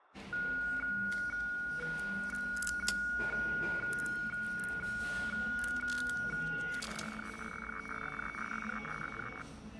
Weather fax (radiofax), 120 lines a minute, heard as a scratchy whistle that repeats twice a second, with room echo and the noise of a cafe.